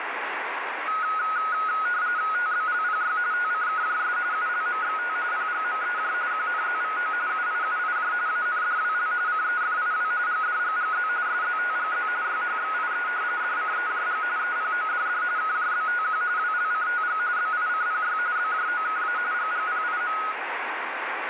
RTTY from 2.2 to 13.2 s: TBLPY TCKJS ULMXT PGMEJ QNZVO UIUIJ ANDWL CEFIW GDGGZ SZTGZ YHXIE

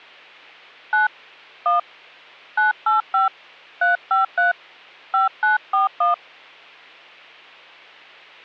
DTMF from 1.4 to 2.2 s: 1

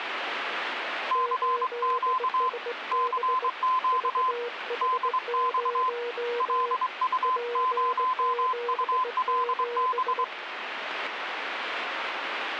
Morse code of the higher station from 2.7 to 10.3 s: CQ DX LU0ULB

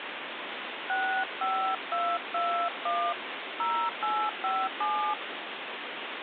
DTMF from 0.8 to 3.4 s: 65221

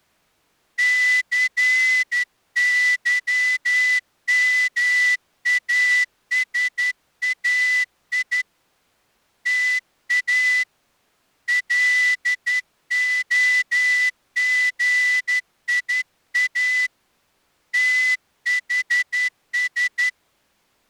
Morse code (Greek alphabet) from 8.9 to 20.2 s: ΤΑ ΛΟΓΙΑ ΤΗΣ

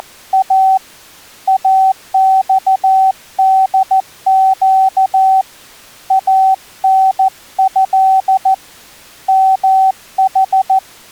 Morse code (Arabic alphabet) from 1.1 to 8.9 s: اصدق انه

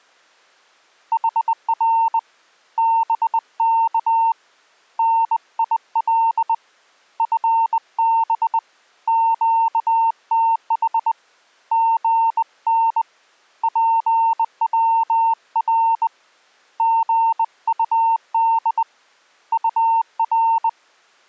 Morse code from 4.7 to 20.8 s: NIL FB QTH GN PWR GUD UR

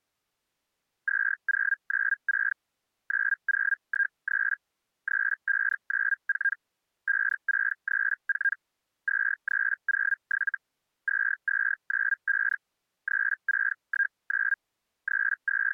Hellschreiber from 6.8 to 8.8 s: 5634

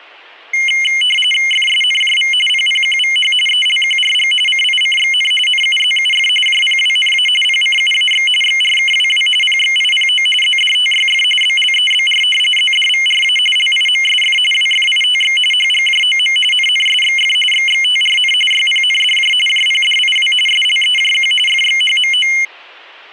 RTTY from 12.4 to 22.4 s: ZDVRA LIMSF WFITX HGJOM NNSXF XXTRN YPNDJ JPDIW SLEJQ FXHMO

